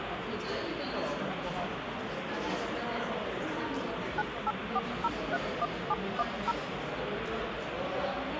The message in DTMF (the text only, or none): 984031710